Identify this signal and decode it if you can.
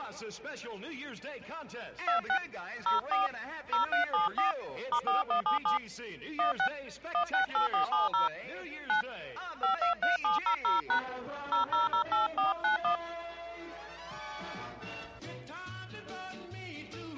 DTMF, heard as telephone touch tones, dialled by hand, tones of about 120 ms. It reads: 26 04 0374 *4177 16 168470 9 523700# 0008491